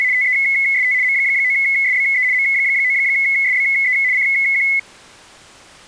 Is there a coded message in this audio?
Yes: RTTY (75 baud, 170 Hz shift) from 0.0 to 4.8 s, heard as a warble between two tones, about 2100 Hz centre. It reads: … TEST M9SBE M9SBE CQ